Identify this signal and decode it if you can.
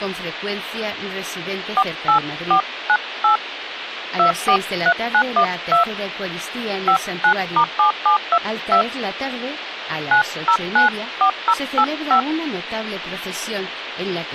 DTMF, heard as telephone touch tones, dialled by hand, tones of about 90 ms, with phone line noise and speech in Spanish. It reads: 48498 243912 59*7722 9094085